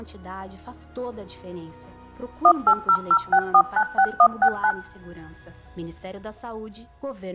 DTMF, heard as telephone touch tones, dialled by machine, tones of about 70 ms. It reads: 18006496169